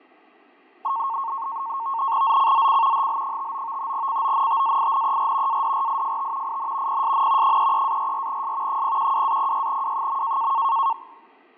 NAVTEX (SITOR-B), 100 baud, 170 Hz shift, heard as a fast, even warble, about 1000 Hz centre, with fading. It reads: ZCZC HL59 CONTAINER ADRIFT IN PSN 33-44S 012-06W.